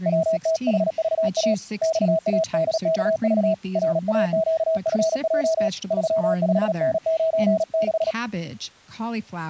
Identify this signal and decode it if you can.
Morse code, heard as a keyed tone, hand-sent with a paddle, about 37 wpm, 650 Hz, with speech in English. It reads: WTHVA XADKV RAQFJ 35N96